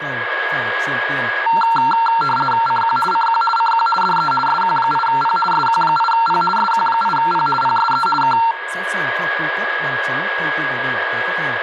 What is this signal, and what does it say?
RTTY (50 baud, 450 Hz shift), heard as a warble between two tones, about 1140 Hz centre, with radio static, a steady whistle near 1650 Hz and speech in Vietnamese. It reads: CQ CQ CQ DE SQ8P SQ8P SQ8P PSE K